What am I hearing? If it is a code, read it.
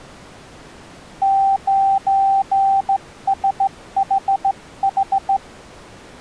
Morse code, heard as a keyed tone, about 15 wpm, 780 Hz. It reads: 9SHH